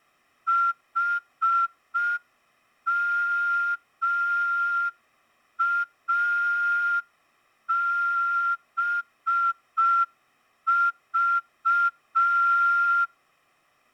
Morse code, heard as a whistle, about 5 wpm. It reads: HMABV